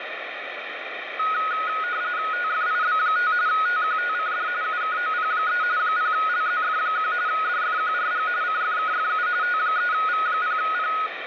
RTTY (45.45 baud, 170 Hz shift), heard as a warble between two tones, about 1360 Hz centre, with radio static. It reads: TFIB5 TQTCD UKOP3 0LZF1 DFQRG CFKFU T3V0P